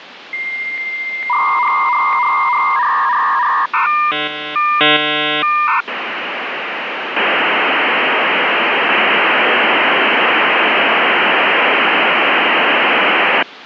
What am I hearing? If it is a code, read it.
Dial-up modem handshake (V.34 or later), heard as a whistle, warbles, then hiss, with phone line noise.